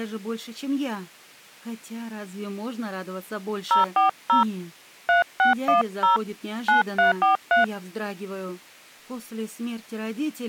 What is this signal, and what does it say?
DTMF, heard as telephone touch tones, dialled by hand, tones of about 130 ms. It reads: 040 3610 9343